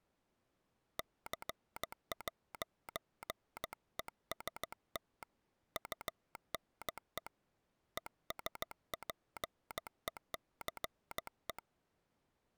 Morse code, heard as a telegraph sounder, hand-sent with a paddle, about 15 wpm. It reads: C'EST UNE ESPECE